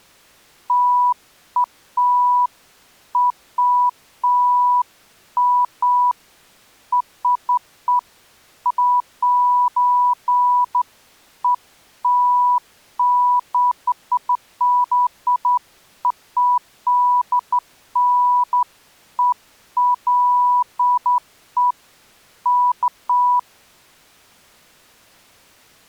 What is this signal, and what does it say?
Beeps of irregular length. There is no code.